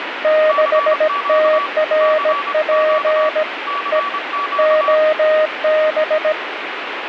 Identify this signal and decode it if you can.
Morse code, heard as two keyed tones, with radio static. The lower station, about 17 wpm, 620 Hz: 6TRP E OB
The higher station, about 24 wpm, 1140 Hz: CQ CQ CQ